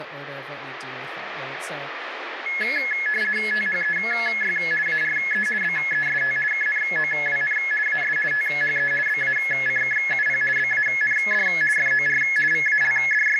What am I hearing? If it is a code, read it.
RTTY (50 baud, 450 Hz shift), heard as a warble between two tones, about 1950 Hz centre, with radio static and speech in English. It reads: THEY ARE BEST KNOWN AS THE BACKUP BAND FOR …